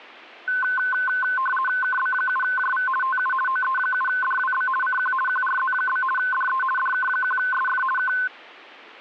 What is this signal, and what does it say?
RTTY (50 baud, 450 Hz shift), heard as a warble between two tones, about 1280 Hz centre. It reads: KB7JV TU OE7DWB CQ QRZ? DE DK1SF K